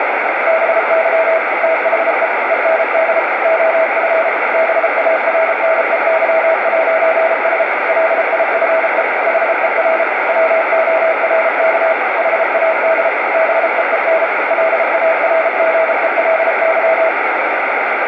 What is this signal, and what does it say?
Morse code, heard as a keyed tone, machine-sent, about 33 wpm, 650 Hz, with heavy radio static. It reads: BY THE END OF BARNEY'S LIFE HER WORK HAD BEEN LARGELY